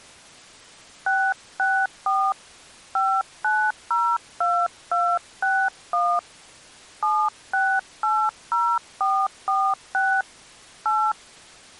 DTMF, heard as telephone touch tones, dialled by hand, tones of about 260 ms. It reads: 664 5902261 7680446 8